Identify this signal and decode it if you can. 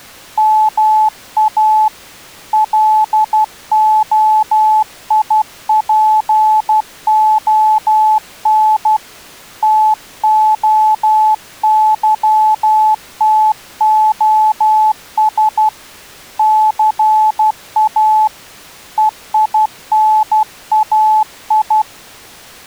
Morse code (Greek alphabet), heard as a keyed tone, hand-sent with a paddle, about 12 wpm, 860 Hz. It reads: ΜΑ ΛΟΙΠΟΝ ΤΟΥΤΟΣ ΘΑ ΕΙΝΑΙ